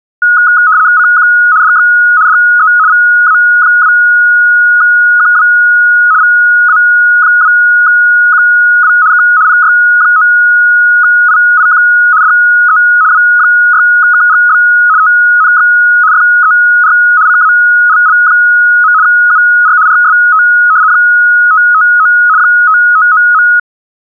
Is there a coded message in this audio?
Yes: RTTY (75 baud, 170 Hz shift) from 0.2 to 23.6 s, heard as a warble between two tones, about 1360 Hz centre. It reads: CQ DX DE VA2QW VA2QW K PY9IIQ DE W6KGB TNX FER CALL. UR RST 559 559.